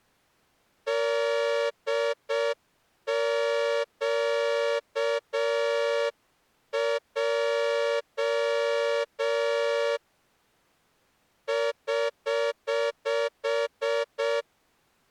Morse code, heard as a horn, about 6 wpm. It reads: DQJ <HH>